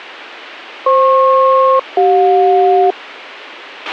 Aircraft SELCAL, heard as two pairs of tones, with a squelch burst at the end. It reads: FP-CJ